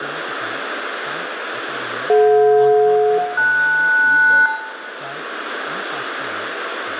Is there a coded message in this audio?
Yes: aircraft SELCAL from 2.1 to 4.5 s, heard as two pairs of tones, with radio static, room echo and speech in Assamese. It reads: DJ-LS